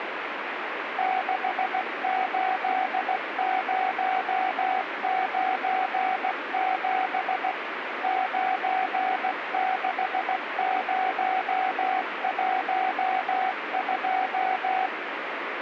Morse code, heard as a keyed tone, machine-sent, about 16 wpm, 750 Hz, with radio static. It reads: 68097 96012